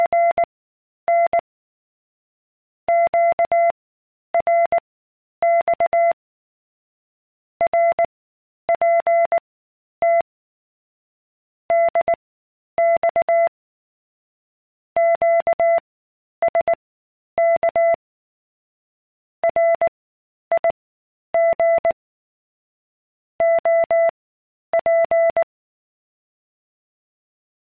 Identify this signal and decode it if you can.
Morse code, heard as a keyed tone, machine-sent, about 19 wpm, spaced as for 10 wpm, 680 Hz. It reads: … QRX RPT DX QSK RIG OP